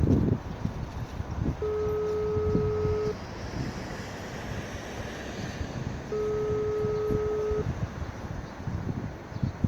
Telephone call progress tone (single-tone plan, as in most of Europe), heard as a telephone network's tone, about 420 Hz, 1.5 s on and 3 s off, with street noise. Ringback tone.